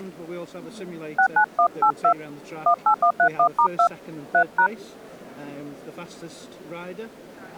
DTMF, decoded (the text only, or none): 69182 18131*2 3#